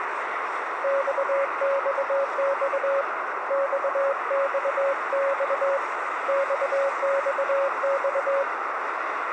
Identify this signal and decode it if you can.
Morse code, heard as a keyed tone, hand-sent with a straight key, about 22 wpm, 550 Hz, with radio static, a narrow filter and street noise. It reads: XXX XXX XXX